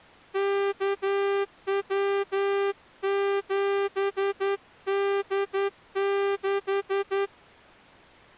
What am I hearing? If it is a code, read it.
Morse code, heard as a horn, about 11 wpm. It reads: KW7D6